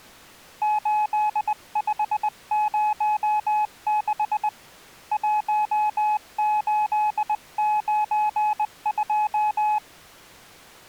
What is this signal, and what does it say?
Morse code, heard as a keyed tone, hand-sent with a bug key, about 20 wpm, 850 Hz. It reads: 8506 1892